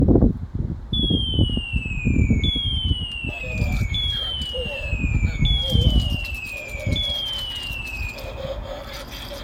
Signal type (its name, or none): none